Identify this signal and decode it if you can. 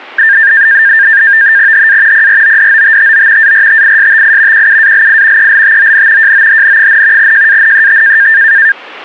NAVTEX (SITOR-B), 100 baud, 170 Hz shift, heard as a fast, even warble, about 1700 Hz centre. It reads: HA PRODOTTO ARTISTI QUALI ELTON JOHN, JANET